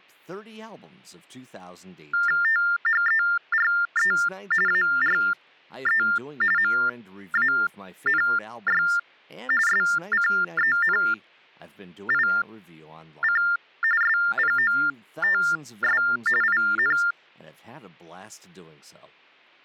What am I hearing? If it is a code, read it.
TTY/TDD text telephone tones (45.45 baud Baudot), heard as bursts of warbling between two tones, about 400 Hz shift, 1600 Hz centre, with speech in English. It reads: THERE ARE MANY SCENIC SPOTS IN